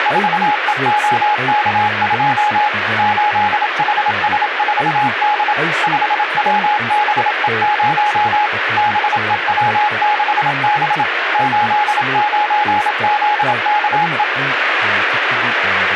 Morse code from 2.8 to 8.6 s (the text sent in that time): 8HS4D 5WBE0